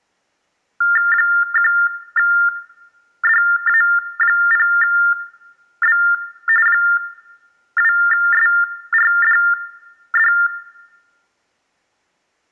TTY/TDD text telephone tones (45.45 baud Baudot), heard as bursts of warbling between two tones, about 400 Hz shift, 1600 Hz centre, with room echo. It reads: 1DA0B 2SRDD